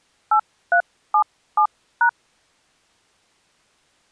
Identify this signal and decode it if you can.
DTMF, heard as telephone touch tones, dialled by hand, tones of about 80 ms. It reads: 8377#